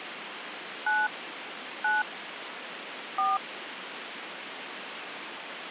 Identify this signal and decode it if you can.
DTMF, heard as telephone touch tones, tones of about 190 ms, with phone line noise. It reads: 9 9 4